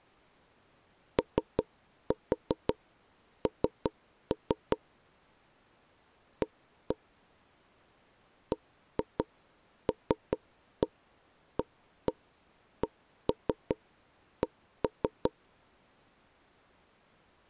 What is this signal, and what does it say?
Tap code, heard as knocks on wood, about 5 knocks a second. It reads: ON A BLACK